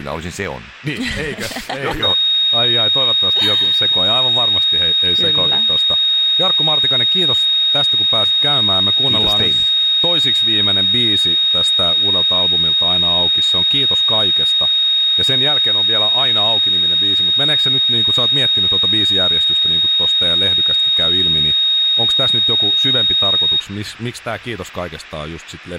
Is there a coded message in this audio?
No, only a steady tone, with speech in Finnish.